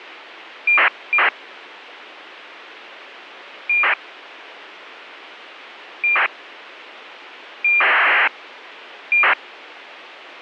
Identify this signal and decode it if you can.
ACARS aircraft data, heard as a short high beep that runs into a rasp, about 2400 baud.